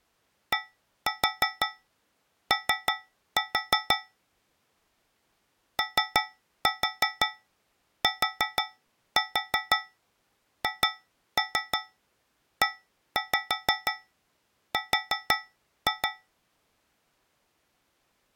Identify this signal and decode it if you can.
Tap code, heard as taps on a metal pipe, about 6 knocks a second. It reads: DO OTHER